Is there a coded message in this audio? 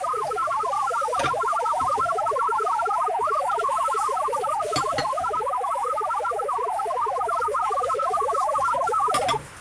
Yes: multi-tone FSK (Olivia or MFSK type), about 1000 Hz wide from 0.0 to 9.4 s, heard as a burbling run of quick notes, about 62.5 baud, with radio static and kitchen noise.